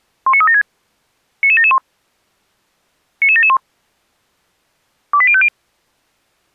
Five-tone selective call (ZVEI), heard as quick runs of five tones, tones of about 70 ms. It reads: 19376 99771 99771 28050